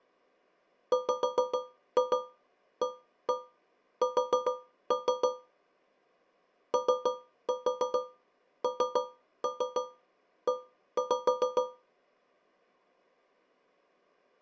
Tap code, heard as taps on a metal pipe, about 6 knocks a second. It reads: WAS ONE